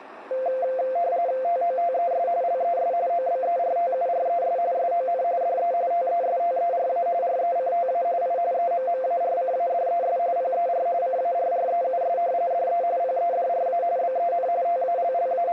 RTTY (45.45 baud, 170 Hz shift), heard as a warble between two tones, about 610 Hz centre, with radio static. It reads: TOTES LES OBERTURES SON DE TESTERA RECTA I EMMARCADES PER CARREUS DE PEDRA BEN …